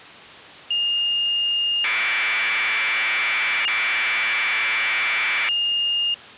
Commodore tape loading (standard loader), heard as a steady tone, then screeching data.